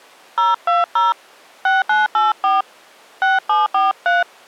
DTMF, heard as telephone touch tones, dialled by hand, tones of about 170 ms. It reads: 020 6984 6743